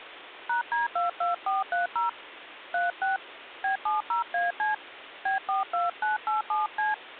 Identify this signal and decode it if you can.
DTMF, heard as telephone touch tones, dialled by hand, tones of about 140 ms, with phone line noise. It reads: #D22430 36 B70AC B42987C